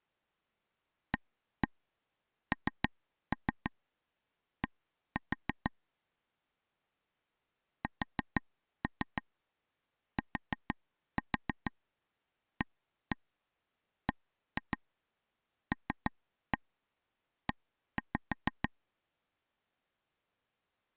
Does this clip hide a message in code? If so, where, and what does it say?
Yes: tap code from 1.1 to 18.7 s, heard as taps on a table, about 6 knocks a second. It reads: AND STABLE